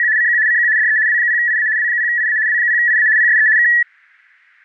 RTTY (75 baud, 170 Hz shift), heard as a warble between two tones, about 1800 Hz centre. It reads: … CQ CQ DE W0IA W0IA W0IA PSE K